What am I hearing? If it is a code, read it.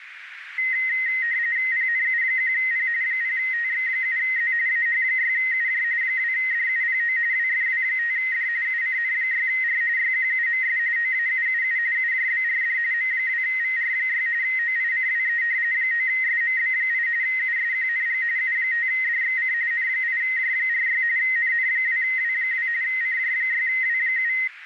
RTTY (45.45 baud, 170 Hz shift), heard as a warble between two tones, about 1950 Hz centre, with radio static and a narrow filter. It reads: PNU1P 0TX7Z AH6UJ 2DUPO WFW5D UCN6R YQUMS OAUUU UJBRD M2VR6 OICWE 9SMB8 USQNG U5DXC N8J46 NN2W2 CJ6W7